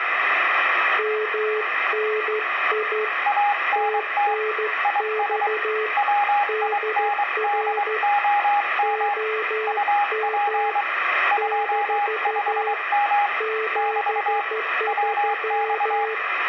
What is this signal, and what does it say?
Morse code, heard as two keyed tones, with radio static. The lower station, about 13 wpm, 440 Hz: MNI TNX DR OM - 73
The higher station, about 23 wpm, 820 Hz: ANT IS WINDOM UP 25M <BT> WX